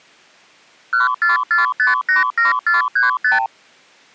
Multi-frequency trunk signalling (R2, with the far end's replies), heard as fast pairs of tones, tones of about 140 ms. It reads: 144587435